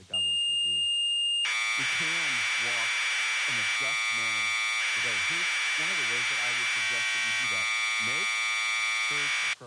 Commodore tape loading (standard loader), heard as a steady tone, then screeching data, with speech in English.